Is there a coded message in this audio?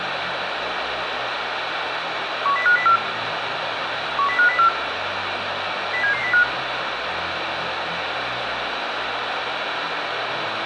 Yes: five-tone selective call (CCIR) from 2.5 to 6.4 s, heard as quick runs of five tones, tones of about 100 ms, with radio hiss. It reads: 10504 10504 07705